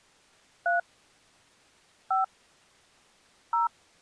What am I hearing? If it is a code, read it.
DTMF, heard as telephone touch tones, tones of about 140 ms. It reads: 3 5 0